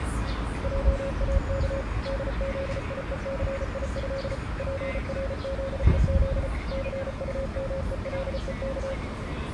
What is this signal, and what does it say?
Morse code (with Polish letters), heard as a keyed tone, machine-sent, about 34 wpm, 540 Hz, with street noise. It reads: JAK DZIECIĘ PRZEZ CUMELEK